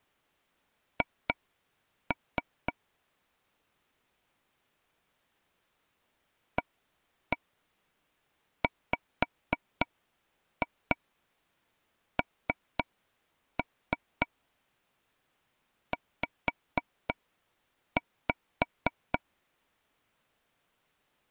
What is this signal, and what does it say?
Tap code, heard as taps on a table, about 3 knocks a second. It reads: H AWNZ